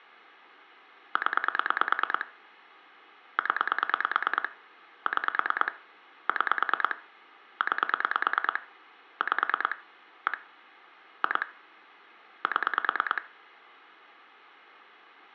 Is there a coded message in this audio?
Yes: pulse dialling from 1.2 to 13.2 s, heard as clicks on a phone line, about 9 pulses a second, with room echo. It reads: 0 0 6 6 9 5 1 2 7